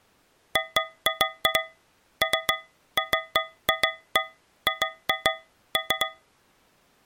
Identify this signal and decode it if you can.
Irregular taps on a metal pipe. There is no code.